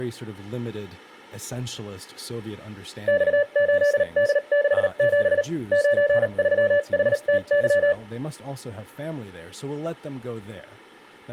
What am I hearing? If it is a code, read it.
Morse code, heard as a keyed tone, machine-sent, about 38 wpm, spaced as for 33 wpm, 580 Hz, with speech in English. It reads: X8D67 93HTY